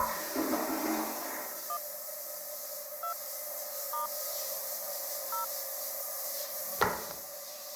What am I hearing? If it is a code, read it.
DTMF, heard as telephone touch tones, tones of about 100 ms, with the noise of a restroom. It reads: 1 2 * 0